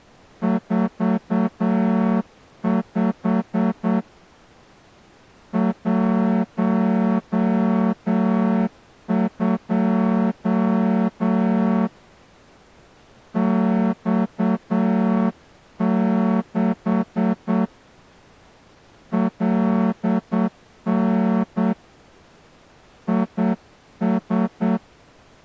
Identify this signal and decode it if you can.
Morse code, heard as a horn, hand-sent with a straight key, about 8 wpm. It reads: 45 12 X6 LN IS